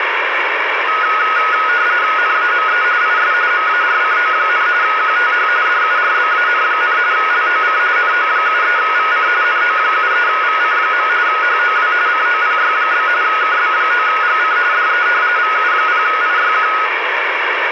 RTTY (45.45 baud, 170 Hz shift), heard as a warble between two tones, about 1360 Hz centre, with radio static. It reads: NAME IS MARCO, QTH DURBAN, LOC NO73VC NO73VC. HOW COPY? KB9GC DE VU0IYQ